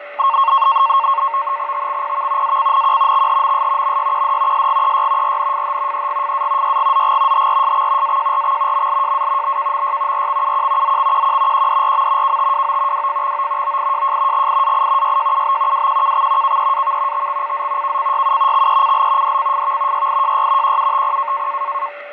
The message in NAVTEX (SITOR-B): TXPV ACNQ XHMS MYQD SGEY RNFH EGFA YGZG HRSX AJRX MLJA BKMY RXUQ ZXQQ QDRM KTWO WFXO OIJJ GIAI YJUB WQKX KEAV TXCZ KCYU XECL DCFV YIJY QUTP

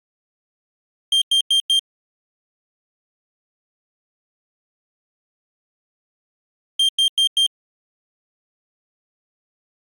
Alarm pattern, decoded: temporal four

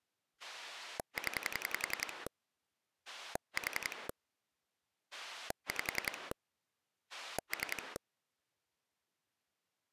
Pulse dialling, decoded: 0 4 5 3

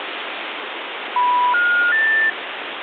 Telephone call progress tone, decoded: special information tone

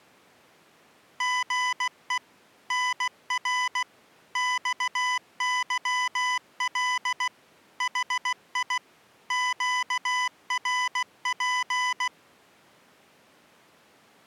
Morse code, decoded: GE NR XYL HI QRP

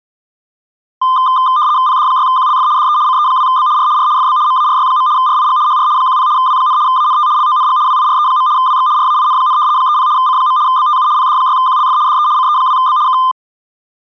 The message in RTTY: PD6QLF DE CE2B R R FB MARY. RIG HR 10 W, ANT LONG WIRE. WX RAIN, 30 C. BTU PD6QLF DE CE2B K

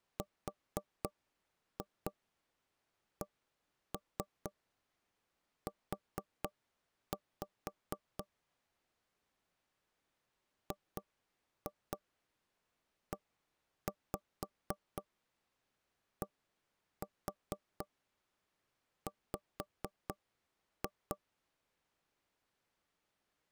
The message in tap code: RCU GEDW

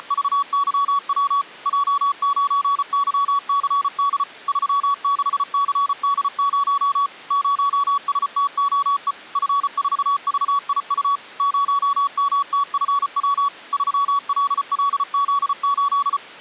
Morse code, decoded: … J9YCD 36CD0 0STOE F4VIU 0MTFW 3LLZ8

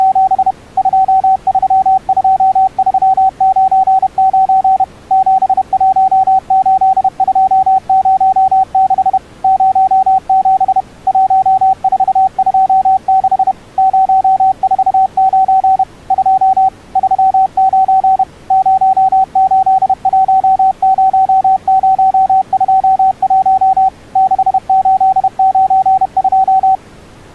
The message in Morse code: … 232399 718206 07 1426 049 2 39 0810021 6892

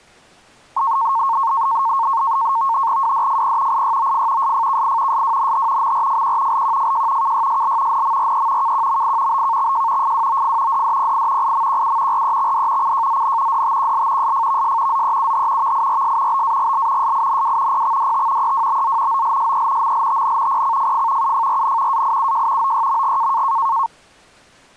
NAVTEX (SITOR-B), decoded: WDFP IYOF SFKI SWNH MRFQ LQFJ KYSL NMRE KQMI BKXJ FWOF DDPI IMQU REXD CJZN DTQL SFVS ZEUH VIRS BAGL SINW PXDT EWBZ OLSE MLTN PCFF UFRN AIUJ OYMG

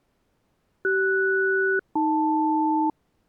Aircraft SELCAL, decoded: CS-AL

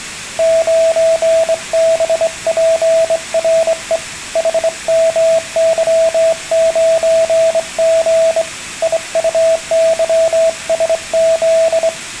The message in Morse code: 9BPRE HMY9G IUYSZ

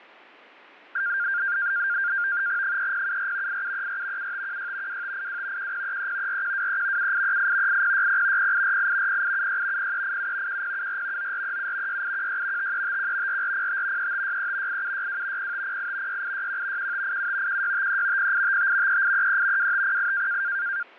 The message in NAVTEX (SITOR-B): 3074 8734 7516 2582 1033 4123 7838 8060 0848 0876 0387 1074 9437 6816 5351 4405 3563 8762 0508 6861 1587 1653 0855 3833 2508

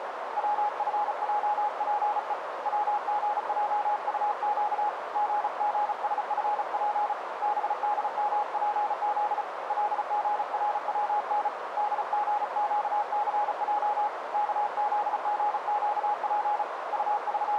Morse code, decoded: WFJPE WGJUQ GGSFP BDMPZ LGRWN DGQCJ KZGQP …

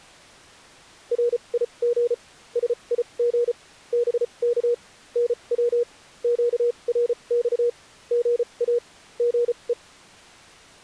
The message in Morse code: RIG SIG BK NW QRX GA GE

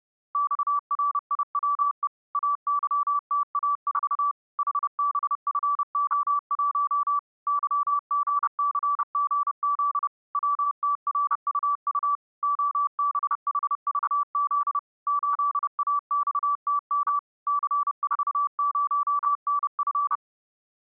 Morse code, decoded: XRIWE AYTA4 HBFO1 YGCGZ WTRUU OBHVZ 8AXTM C40NF

